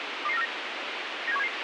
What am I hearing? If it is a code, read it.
Five-tone selective call (EEA), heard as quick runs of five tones, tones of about 40 ms, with radio hiss and a squelch burst at the end. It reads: 22949 97177